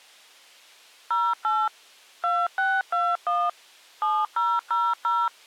DTMF, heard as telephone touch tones, dialled by machine, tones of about 230 ms. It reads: 08 2621 7000